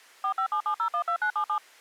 DTMF, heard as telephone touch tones, dialled by machine, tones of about 90 ms. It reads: 4577012977